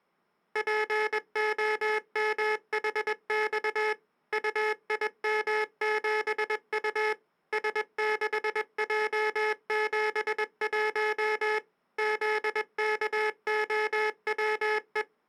Morse code, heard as a buzzer, machine-sent, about 21 wpm. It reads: POMHX UIM7U S6J71 ZKOWE